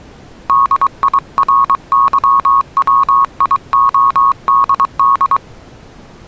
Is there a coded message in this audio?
Yes: Morse code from 0.4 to 5.4 s, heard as a keyed tone, hand-sent with a paddle, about 23 wpm, 1100 Hz. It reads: DIRYWIODD